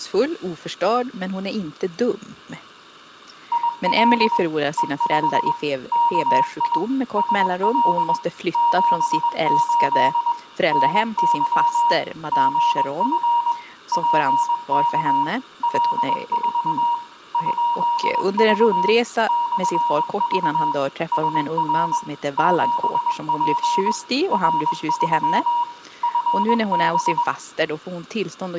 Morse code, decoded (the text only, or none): IL E5 KI SL 78 NY GF PK L4 ?V /V SR 7P R3 FB